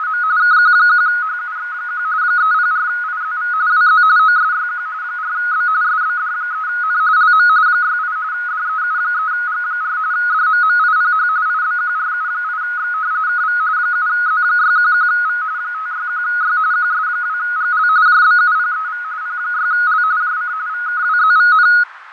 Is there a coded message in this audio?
Yes: RTTY (45.45 baud, 170 Hz shift) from 0.0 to 21.8 s, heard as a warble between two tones, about 1360 Hz centre, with radio static, fading and a narrow filter. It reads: … KQ1HUX1 304IZV WZ OSYQ 4B SBD3N LM 68 DEU3G4 DMMIPH IBQRU8X KV 7Z611V 561Y QS2GL JBUPEV P6L JC VKWZVN